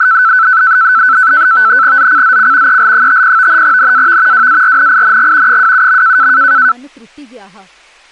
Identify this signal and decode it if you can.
NAVTEX (SITOR-B), 100 baud, 170 Hz shift, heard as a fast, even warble, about 1420 Hz centre, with speech in Dogri. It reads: ZCZC EL50 NAV WARNING 27.